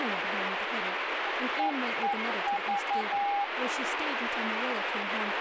Morse code, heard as a keyed tone, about 11 wpm, 810 Hz, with radio static, a weaker station near 2170 Hz and speech in English. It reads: EEV